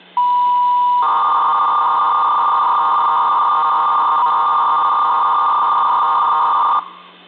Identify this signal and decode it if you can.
300-baud modem data (V.21 tones), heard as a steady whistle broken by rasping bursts, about 300 baud, 200 Hz shift, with hum.